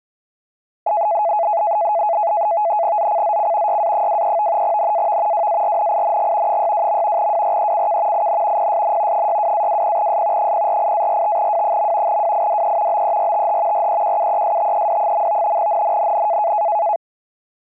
NAVTEX (SITOR-B), 100 baud, 170 Hz shift, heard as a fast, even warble, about 760 Hz centre. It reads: ZCZC YA23 NAV WARNING 62. WRECK IN PSN 62-20S 048-45W. WIDE BERTH REQUESTED. NNNN